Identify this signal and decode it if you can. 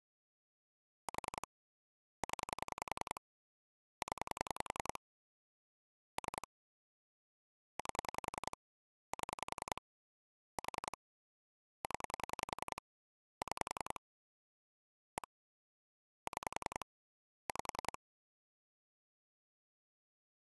Pulse dialling, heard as clicks on a phone line, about 10 pulses a second. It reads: 4 0 0 3 8 7 4 0 6 1 6 5